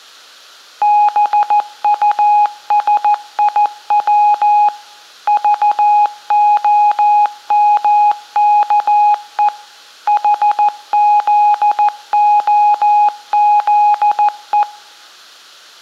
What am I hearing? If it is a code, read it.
Morse code (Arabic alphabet), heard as a keyed tone, machine-sent, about 14 wpm, 830 Hz. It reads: بطسيو ضخمكء حذخذء